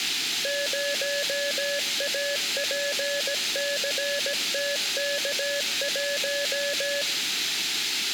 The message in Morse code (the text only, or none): 0APCTK1